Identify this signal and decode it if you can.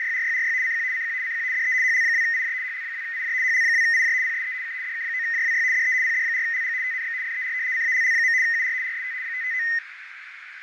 RTTY (75 baud, 170 Hz shift), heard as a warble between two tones, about 1950 Hz centre, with radio static, fading and a narrow filter. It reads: … CQ CQ CQ DE HL2IJ HL2IJ HL2IJ PSE K DK9JWY DE PD4LG TNX FER CALL. UR RST 559